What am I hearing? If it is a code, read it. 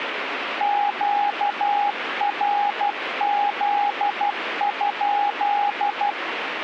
Morse code, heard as a keyed tone, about 12 wpm, 820 Hz, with radio static. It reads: QRZ?